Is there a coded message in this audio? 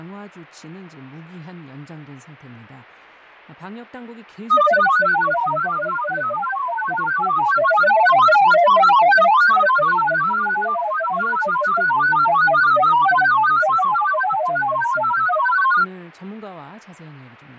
Yes: multi-tone FSK (Olivia or MFSK type), about 1000 Hz wide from 4.5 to 15.9 s, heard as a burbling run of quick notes, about 31.25 baud, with fading and speech in Korean.